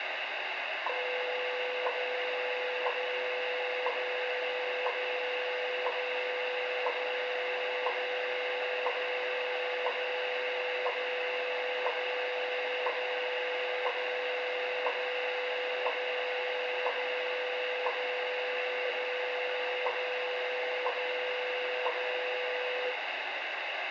Radio time signal (WWV, Colorado), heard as ticks, one a second, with radio static and room echo.